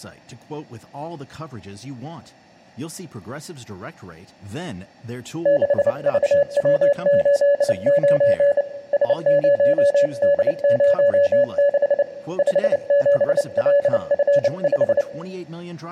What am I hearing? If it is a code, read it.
Morse code, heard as a keyed tone, hand-sent with a bug key, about 29 wpm, 570 Hz, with room echo. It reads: 6VW89 S0D06 57LF5